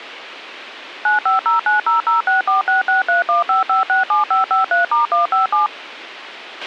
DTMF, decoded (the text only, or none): 9509006466315567553*157